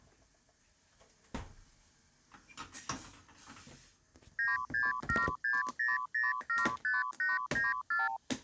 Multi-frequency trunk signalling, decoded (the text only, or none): 96760075894